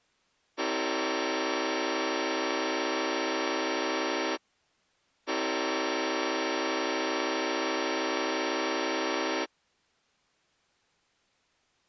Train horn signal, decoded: 2 long

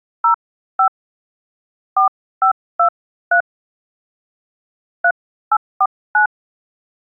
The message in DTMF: 05 4523 3849

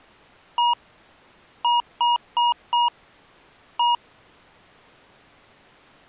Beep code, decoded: 1-4-1

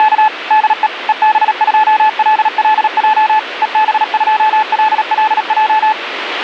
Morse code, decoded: … DE EB2LLJ EB2LLJ

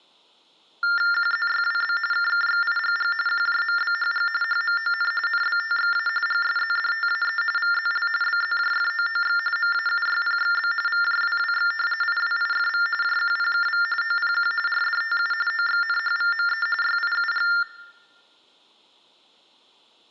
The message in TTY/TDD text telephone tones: QZYWB KKXIGG QJMBHG HMON NBTXA GSZDTAE VZL BZJFOOX MAUYPXB VJWWX IWIFV JQPKV OPQ RDTU OXNHVME YIUG

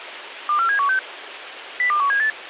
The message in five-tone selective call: 24716 02178

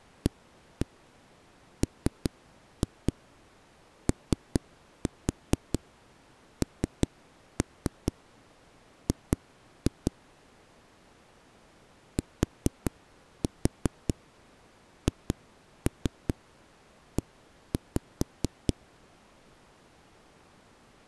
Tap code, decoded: AMONG THE

